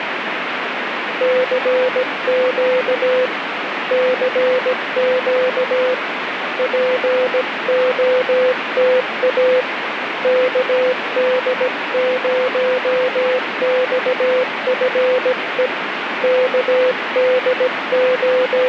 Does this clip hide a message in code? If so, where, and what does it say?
Yes: Morse code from 1.2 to 18.7 s, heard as a keyed tone, hand-sent with a paddle, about 17 wpm, 510 Hz, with radio static. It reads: CQ CQ POTA KD0XFE …